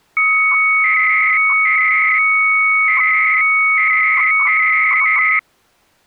300-baud modem data (Bell 103 tones), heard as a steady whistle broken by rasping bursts, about 300 baud, 200 Hz shift.